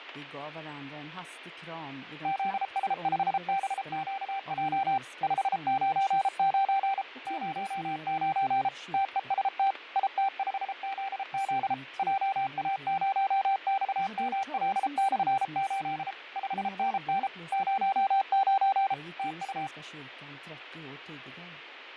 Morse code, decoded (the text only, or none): ZS5BQJ 599 09 TEST IT5ZZ JA0XML/8 5NN 09 TU